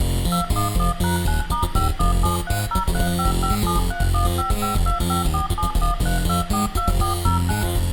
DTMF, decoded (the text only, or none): 211#9*5173035573155254713242409